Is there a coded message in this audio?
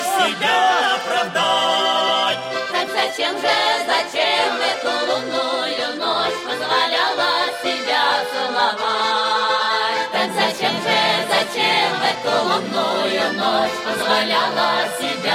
No.